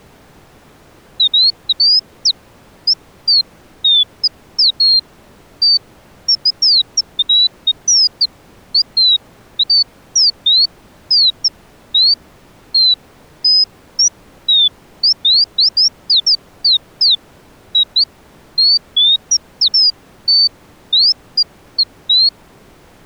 Bird-like chirps. There is no code.